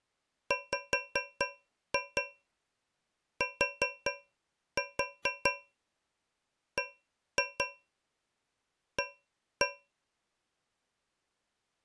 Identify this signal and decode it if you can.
Tap code, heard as taps on a metal pipe, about 4 knocks a second. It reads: WTBA